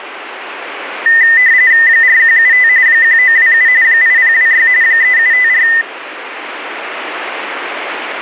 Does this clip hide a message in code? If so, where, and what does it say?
Yes: RTTY (45.45 baud, 170 Hz shift) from 1.1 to 5.8 s, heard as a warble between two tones, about 1900 Hz centre, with radio static. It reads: 4175 1927 8026 3754